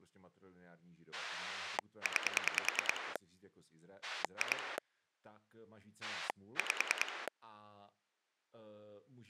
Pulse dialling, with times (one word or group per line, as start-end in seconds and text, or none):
1.1-3.2 9
4.0-4.8 2
6.0-7.3 5